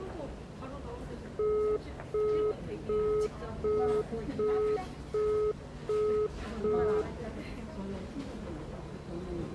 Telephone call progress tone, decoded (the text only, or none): busy tone